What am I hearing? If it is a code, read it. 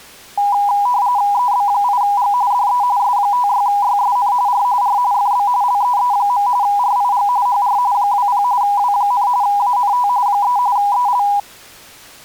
RTTY (45.45 baud, 170 Hz shift), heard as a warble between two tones, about 900 Hz centre. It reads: EB8G DE S56YSN R R FB LEE. RIG HR 20 W, ANT 3 EL